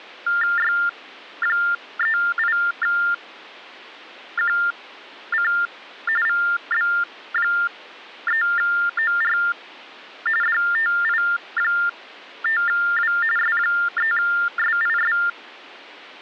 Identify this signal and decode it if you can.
TTY/TDD text telephone tones (45.45 baud Baudot), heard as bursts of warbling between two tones, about 400 Hz shift, 1600 Hz centre. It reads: Y38QC VB3OR DTI5W S3SIS